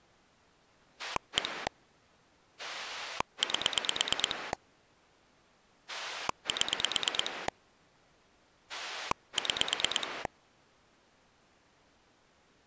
Pulse dialling, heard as a rotary dial, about 9 pulses a second. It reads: 1 8 7 6